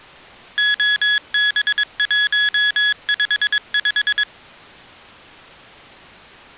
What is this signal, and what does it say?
Morse code, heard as electronic beeps, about 22 wpm, 1700 Hz. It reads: OB155